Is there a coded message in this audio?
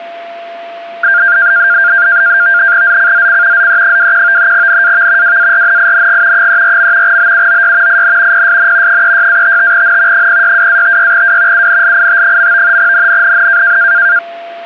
Yes: NAVTEX (SITOR-B), 100 baud, 170 Hz shift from 1.0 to 14.2 s, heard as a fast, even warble, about 1500 Hz centre, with a steady whistle near 680 Hz. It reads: ZCZC ZE21 NAV WARNING 34. BUOY IN PSN 36-55N 062-56W UNLIT. NNNN